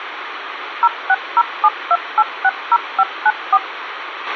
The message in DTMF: 06072860594

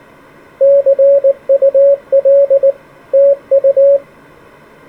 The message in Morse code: CUL TU

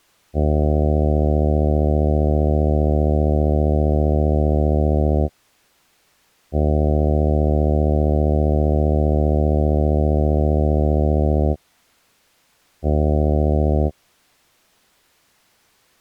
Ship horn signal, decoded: 2 long, 1 short

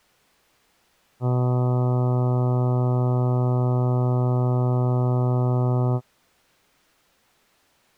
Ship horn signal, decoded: 1 long

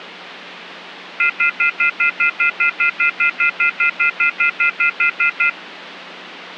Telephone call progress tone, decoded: off-hook warning tone

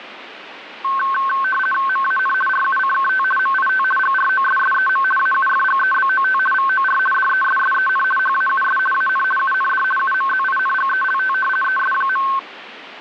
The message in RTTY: MAN RUCKT MIT GROSSEM AUFGEBOT VOR DESSEN HAUS AN UND UMZINGELT ES.

